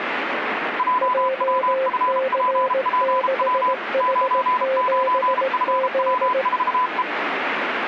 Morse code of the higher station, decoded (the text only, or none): JWFPPW 99FW4E